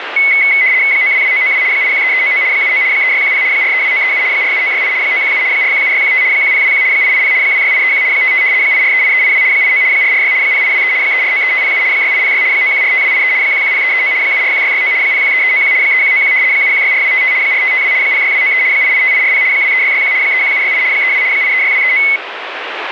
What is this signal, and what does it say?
RTTY (75 baud, 170 Hz shift), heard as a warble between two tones, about 2100 Hz centre, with radio static. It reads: 922992 813399 79 3610 432937 47968 917 417615 1021 880 26831 55 8438382 89 446 0823 3493507 6806 9145283 110339 741669 013391 3191 7164255 4552 06293 885840 23661 31768 32 836239